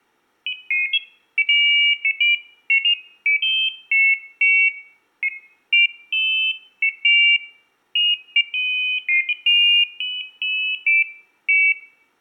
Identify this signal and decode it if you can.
Pairs of high tones at irregular times. There is no code.